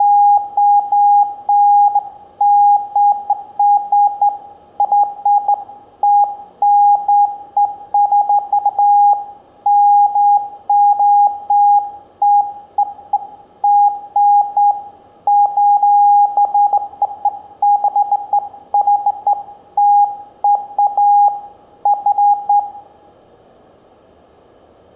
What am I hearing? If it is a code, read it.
Beeps of irregular length, with room echo. There is no code.